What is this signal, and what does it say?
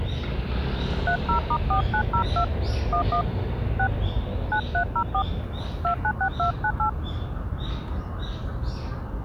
DTMF, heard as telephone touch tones, dialled by hand, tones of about 90 ms, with the noise of a residential street. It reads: 30*4902 11 6 9304 296298